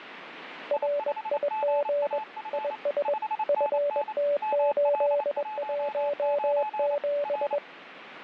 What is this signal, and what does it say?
Morse code, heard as two keyed tones, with radio static. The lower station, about 21 wpm, 580 Hz: RIG IS FT817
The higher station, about 28 wpm, 860 Hz: I5GAF 5NN ML19 R